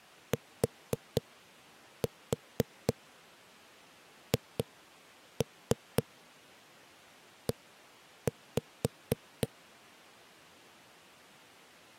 Tap code, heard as knocks on a wall, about 4 knocks a second. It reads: THE